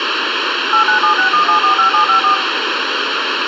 DTMF, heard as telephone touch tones, dialled by machine, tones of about 110 ms, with radio hiss. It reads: 89761745754